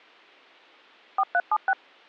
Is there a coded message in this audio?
Yes: DTMF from 1.2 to 1.7 s, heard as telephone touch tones, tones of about 50 ms. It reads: 4376